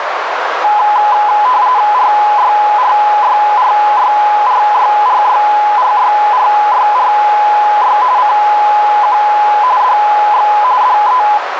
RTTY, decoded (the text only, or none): RYRYRYRYRYRYRYRY CQ DX DE